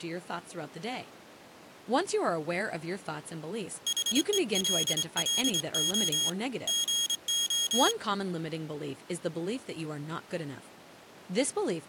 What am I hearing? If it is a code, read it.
Morse code, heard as a high beeper, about 26 wpm, 3300 Hz, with speech in English. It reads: HELLO GO